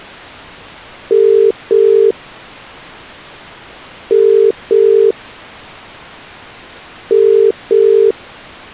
Telephone call progress tone (as in the UK, Ireland, Australia and similar networks), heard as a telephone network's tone, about 400, 450 Hz. Ringback tone.